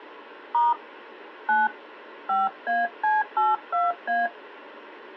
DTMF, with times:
0.5-0.7 *
1.5-1.7 9
2.3-4.3 5AC82A

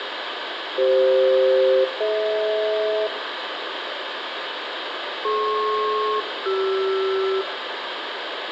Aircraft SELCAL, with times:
0.8-3.1 CF-DH
5.2-7.4 DP-CR

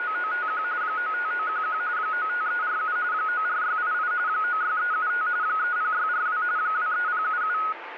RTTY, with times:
0.0-0.6 …
0.8-1.8 95911
2.0-3.0 95347
3.1-4.1 94688
4.3-5.3 96375
5.4-6.4 30642
6.6-7.6 23077

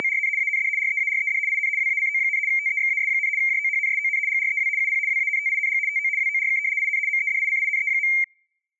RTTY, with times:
0.0-0.3 …
0.4-0.7 AND
0.8-1.4 REARED
1.5-1.7 IN
1.8-2.4 WACO,
2.5-3.3 TEXAS,
3.4-4.2 JOHNSON
4.3-4.7 GREW
4.8-5.0 UP
5.1-5.8 WANTING
5.9-6.1 TO
6.2-6.6 WORK
6.8-7.0 IN
7.1-8.1 MEDICINE.

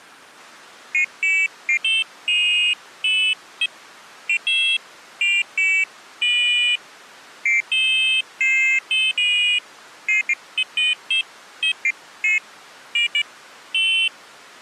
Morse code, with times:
none

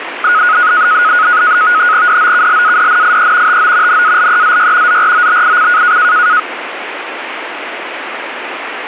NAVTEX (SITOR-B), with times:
2.1-3.6 DOKLADNIE
3.5-4.0 TO
3.9-5.0 NALEZY
4.9-6.0 ZROBIC

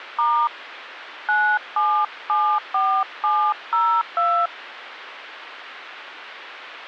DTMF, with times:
0.2-0.5 *
1.3-4.5 9774702

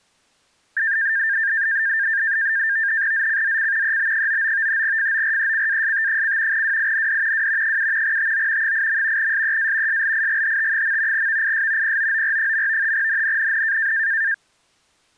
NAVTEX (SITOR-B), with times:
3.1-4.0 ZCZC
3.8-4.8 EB99
4.8-6.6 FORECAST:
6.5-7.5 WIND
7.3-7.8 W
7.6-8.2 7
8.0-8.7 TO
8.6-9.3 8.
9.2-10.0 SEA
9.9-11.3 SLIGHT.
11.1-12.0 VIS
11.8-12.9 POOR.
12.9-13.9 NNNN

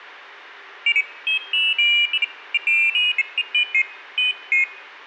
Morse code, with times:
none

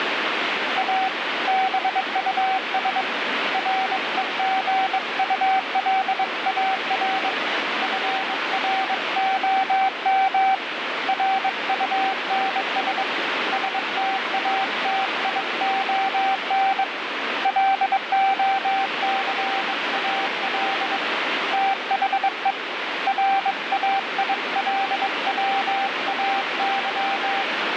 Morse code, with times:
0.8-1.1 A
1.5-3.0 BUS
3.5-7.3 REGULAR
7.8-10.5 FROM
11.1-13.0 RUNS
13.5-16.8 STATION
17.5-21.0 LOCAL
21.5-22.5 THE
23.1-27.4 RAILWAY

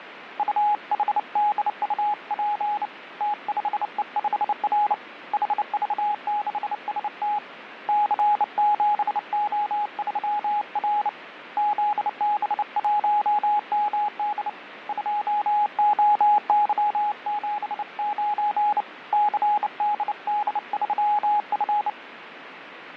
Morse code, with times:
0.4-2.9 UHDUP
3.2-4.9 T5E5R
5.3-7.4 HV6ST
7.9-11.1 C7O3R
11.6-14.5 ZB1MD
14.9-18.8 2OY79
19.1-21.9 CDD3F

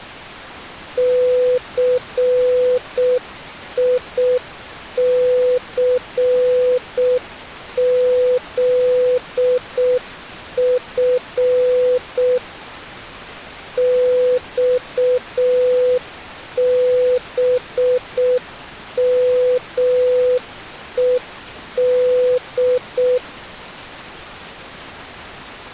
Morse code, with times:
1.0-12.4 CICZF
13.8-23.2 XBMED

